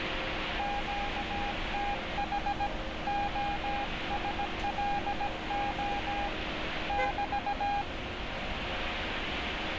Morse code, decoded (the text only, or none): QTH OSLO <BT>